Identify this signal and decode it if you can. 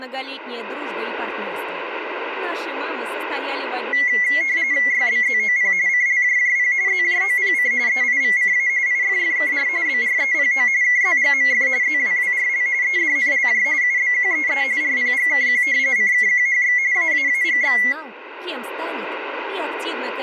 RTTY (45.45 baud, 170 Hz shift), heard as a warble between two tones, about 2050 Hz centre, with room echo. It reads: YBZOP CLJJP ZJOPC EIVCA IFFKR BREPO KZGMF ZWWRL EDNLJ UBQEE RPGKQ CKQHX AAAGX